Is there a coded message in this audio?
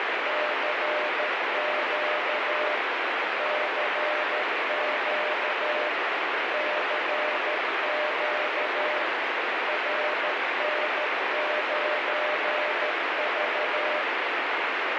Yes: Morse code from 0.2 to 14.1 s, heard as a keyed tone, machine-sent, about 13 wpm, 600 Hz, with heavy radio static. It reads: CQ CQ CQ RN9V